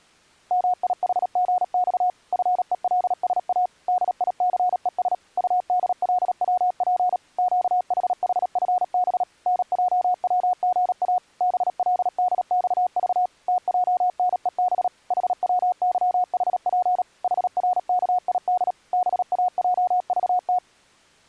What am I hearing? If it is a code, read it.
Morse code, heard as a keyed tone, machine-sent, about 37 wpm, 730 Hz. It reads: MIHGX FELSA DICES UDLWP QHHFB NJWGA BLDXV TJNEB HWYHP HRKID BAJVT